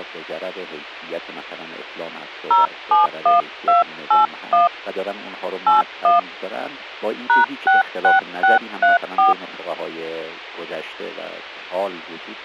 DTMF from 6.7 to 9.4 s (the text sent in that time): #66634